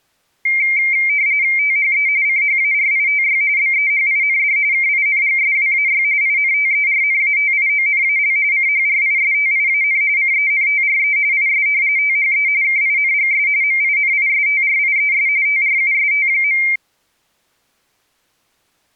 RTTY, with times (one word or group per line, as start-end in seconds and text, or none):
1.6-2.1 THE
2.3-3.4 CHARITY
3.6-4.6 BEHIND
4.7-6.0 KINGSWAY
6.2-8.4 INTERNATIONAL
8.5-10.0 CHRISTIAN
10.2-11.2 CENTRE
11.3-11.7 IS
12.0-12.5 THE
12.6-13.5 KINGS
13.6-15.3 MINISTRIES
15.5-16.6 TRUST.